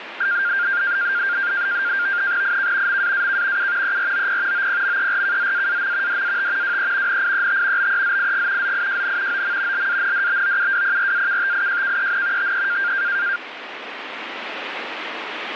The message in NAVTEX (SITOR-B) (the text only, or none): IK MAAK U EROP OPMERKZAAM DAT WE NIET BEZIG ZIJN OM LANDBOUWPRAKTIJKEN TE